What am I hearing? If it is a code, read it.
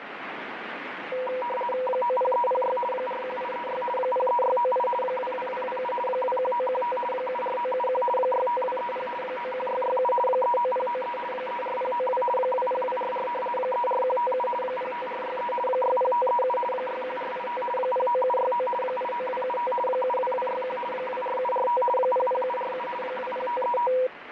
RTTY (50 baud, 450 Hz shift), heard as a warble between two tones, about 740 Hz centre, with radio static. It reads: 90306 41836 03698 22227 21915 74971 65230 91667 39093 34092 20244 34157 05463 60537 61485 09769 89275 72261 24745 00747 20535